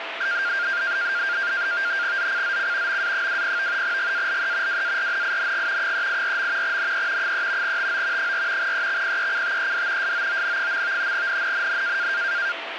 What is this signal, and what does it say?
NAVTEX (SITOR-B), 100 baud, 170 Hz shift, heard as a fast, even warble, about 1500 Hz centre, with radio static and a steady whistle near 670 Hz. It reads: ZCZC MA20 GALE WARNING 384. NE 3 TO 4 EXPECTED SOON. NNNN